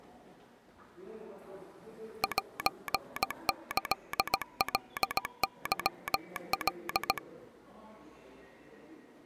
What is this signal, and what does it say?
Morse code (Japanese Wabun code), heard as a telegraph sounder, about 17 wpm, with the noise of a subway station. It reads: セキカケカ